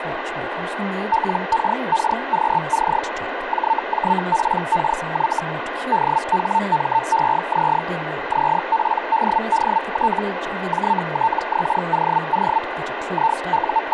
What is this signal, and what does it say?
Hellschreiber (Feld-Hell, 122.5 baud), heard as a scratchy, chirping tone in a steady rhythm, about 900 Hz, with radio static and speech in English. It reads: LKKQC JJPKY DHMEZ ZPDDT JTXOO …